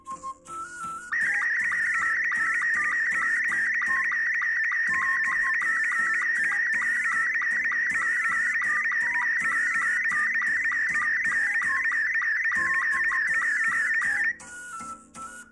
SSTV (slow-scan television), Robot 72, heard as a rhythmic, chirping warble, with room echo.